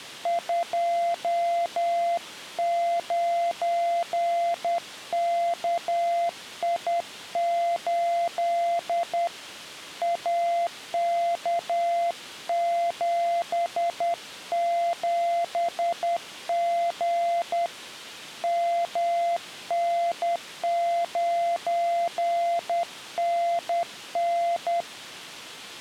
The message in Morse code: 29KI8 AK77G MN9NN

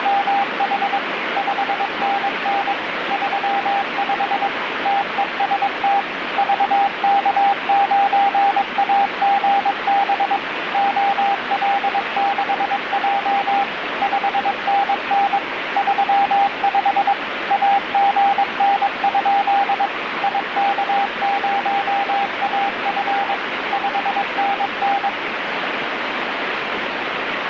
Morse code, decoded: … 5NN 35 TEST VK9AGB OL6J 5NN 35 AGN? IK0AF 5NN

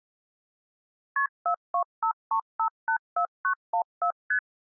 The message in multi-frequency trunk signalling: KP 4253584914 ST

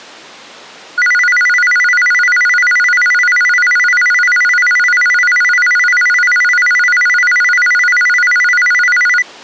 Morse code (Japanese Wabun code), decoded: none

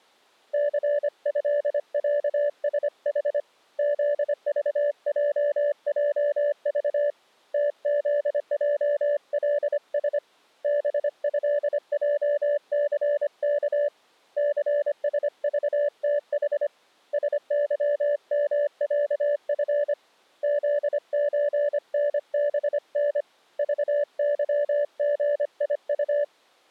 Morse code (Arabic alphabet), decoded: ثهعسح ذضججض تذجلس بهجثك ثسضتح سظمعف ذزنبن ضظغيط

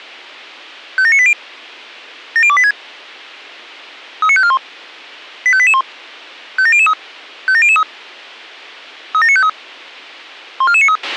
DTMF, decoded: none

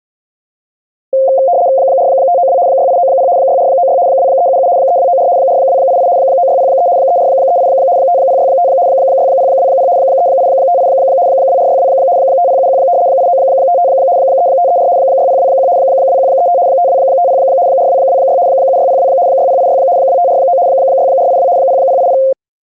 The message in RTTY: 4592 6890 6496 2377 3294 4288 9603 3438 5065 6020 3858 2462 5071 8955 3534 6021 2135 5250 4226 7602 6086 2549 6482 0080

